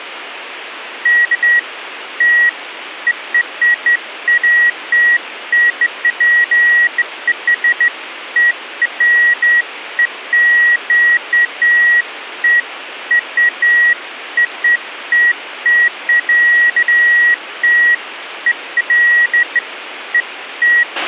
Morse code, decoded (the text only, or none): none